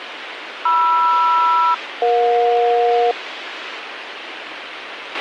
Aircraft SELCAL, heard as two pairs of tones, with radio hiss and a squelch burst at the end. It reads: MR-EJ